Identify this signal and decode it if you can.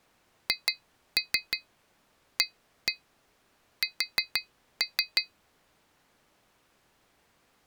Tap code, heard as taps on glass, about 6 knocks a second. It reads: HAS